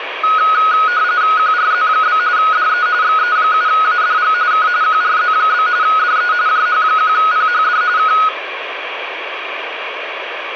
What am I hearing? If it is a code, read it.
RTTY (45.45 baud, 170 Hz shift), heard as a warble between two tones, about 1360 Hz centre, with radio static. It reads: QRZ? DE XE7ADG K QRZ? DE JH1PHD K